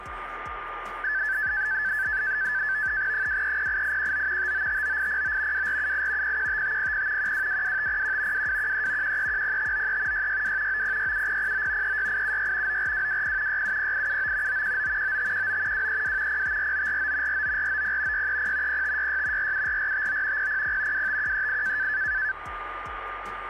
NAVTEX (SITOR-B), 100 baud, 170 Hz shift, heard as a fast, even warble, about 1650 Hz centre, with radio static and a steady whistle near 1210 Hz. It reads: 2308819 5959809 2478 015500 1222501 2213 1310593 662 9067009 36876 94220 670879 919 9519 232 054949 49490 630 0566 474459 000 25138